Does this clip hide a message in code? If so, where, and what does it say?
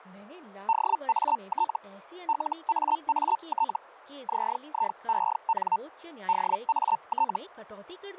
Yes: Hellschreiber (Feld-Hell, 122.5 baud) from 0.7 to 7.4 s, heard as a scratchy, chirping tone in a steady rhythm, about 900 Hz, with speech in Hindi. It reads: DAT LAAT ZIEN DAT